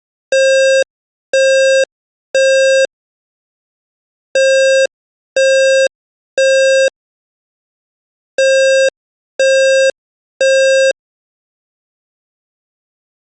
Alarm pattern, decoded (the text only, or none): temporal three